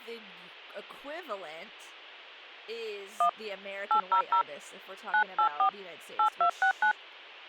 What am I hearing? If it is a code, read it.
DTMF, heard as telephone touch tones, dialled by hand, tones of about 90 ms, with speech in English. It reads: 1 800 984 8269